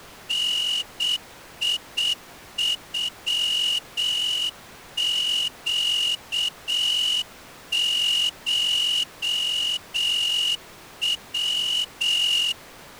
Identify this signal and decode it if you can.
Morse code (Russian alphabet), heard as a whistle, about 7 wpm. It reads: НИЮЩШВ